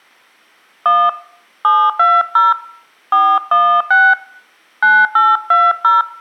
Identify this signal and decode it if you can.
DTMF, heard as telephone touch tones, dialled by hand, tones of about 230 ms. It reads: 1 720 416 9820